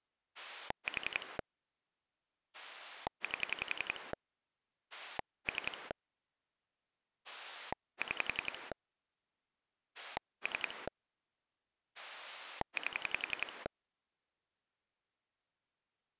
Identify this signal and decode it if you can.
Pulse dialling, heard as a rotary dial, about 11 pulses a second. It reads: 4 8 3 6 3 8